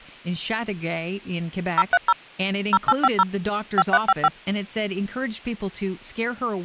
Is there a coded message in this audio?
Yes: DTMF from 1.8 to 4.3 s, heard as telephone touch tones, dialled by machine, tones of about 40 ms, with speech in English. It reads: 030 0850 5355